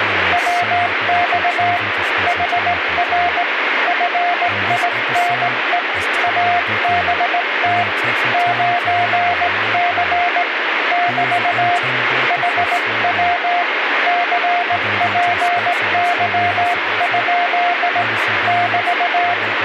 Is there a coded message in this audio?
Yes: Morse code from 0.3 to 19.4 s, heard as a keyed tone, hand-sent with a straight key, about 18 wpm, 700 Hz, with radio static and speech in English. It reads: WX HR FINE ABT 9C <BT> HW CPY? <BT>